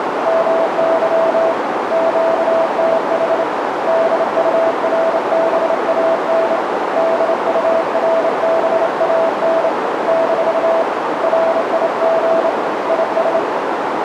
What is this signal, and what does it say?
Morse code, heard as a keyed tone, hand-sent with a straight key, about 28 wpm, 660 Hz, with heavy radio static and a narrow filter. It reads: MY QTH DURBAN DURBAN - RIG IS